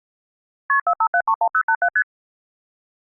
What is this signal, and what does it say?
Multi-frequency trunk signalling (R1, as on North American trunks), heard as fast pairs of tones, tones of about 70 ms. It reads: KP 45731087 ST